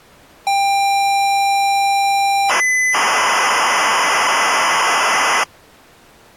ZX Spectrum tape loading, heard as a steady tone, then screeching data.